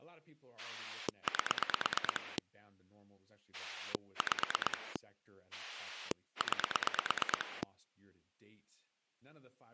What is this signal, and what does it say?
Pulse dialling, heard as a rotary dial, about 9 pulses a second, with speech in English. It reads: 8 5 9